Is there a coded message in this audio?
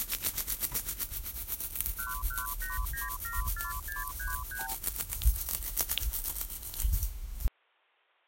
Yes: multi-frequency trunk signalling (R2, with the far end's replies) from 2.0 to 4.7 s, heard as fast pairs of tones, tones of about 160 ms. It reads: 118974633